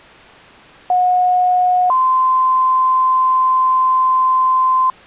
Two-tone page, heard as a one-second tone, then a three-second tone, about 730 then 1040 Hz.